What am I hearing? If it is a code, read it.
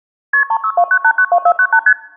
Multi-frequency trunk signalling (R1, as on North American trunks), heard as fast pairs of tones, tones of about 70 ms. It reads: KP 3629892498 ST